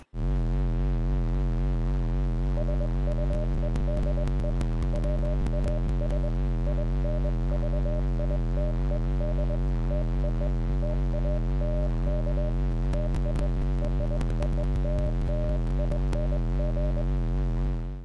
Morse code (American railroad code), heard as a keyed tone, hand-sent with a straight key, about 600 Hz. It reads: SUEDE WAS INVITED TO TALK TO ROLLING